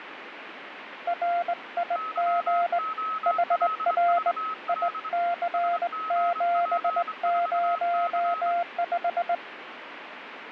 Morse code, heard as two keyed tones, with radio static. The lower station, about 20 wpm, 690 Hz: RIG HR IC705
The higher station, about 25 wpm, 1280 Hz: YOLVL SGP4C